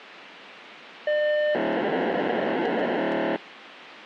POCSAG pager data (1200 baud), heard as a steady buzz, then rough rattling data, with radio hiss and a squelch burst at the end.